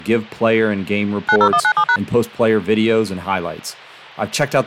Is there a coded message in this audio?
Yes: DTMF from 1.3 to 2.0 s, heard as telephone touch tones, dialled by machine, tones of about 70 ms, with speech in English. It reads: 90197#